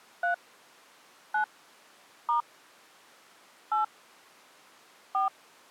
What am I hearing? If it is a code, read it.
DTMF, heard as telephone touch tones, dialled by hand, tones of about 120 ms. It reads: 3 9 * 8 4